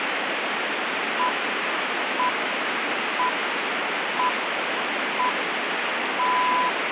Radio time signal (six pips, as the Greenwich Time Signal), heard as pips, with radio static.